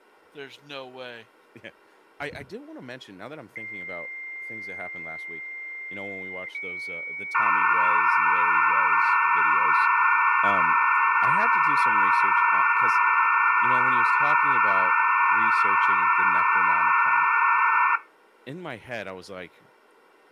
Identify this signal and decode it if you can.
Dial-up modem handshake (low-speed, two carriers), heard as two whistles, then hiss, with speech in English.